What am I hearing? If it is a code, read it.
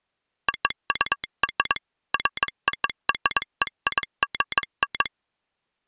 Morse code (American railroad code), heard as a telegraph sounder, machine-sent. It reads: OUR FOREIGN